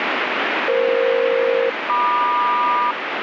Aircraft SELCAL, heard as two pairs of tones, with radio static. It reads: EF-MQ